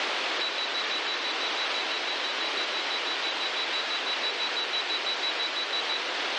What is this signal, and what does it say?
Evenly repeated beeps, with heavy radio static. There is no code.